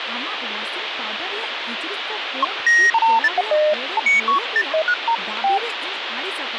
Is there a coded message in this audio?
No, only electronic bleeps of random pitch and length, with radio static and speech in Santali.